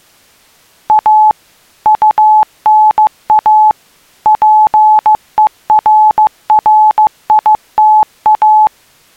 Morse code, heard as a keyed tone, machine-sent, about 15 wpm, 860 Hz. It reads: A UNA PERRITA